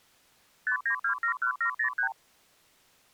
Multi-frequency trunk signalling (R2, with the far end's replies), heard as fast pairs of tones, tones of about 90 ms. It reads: 59271703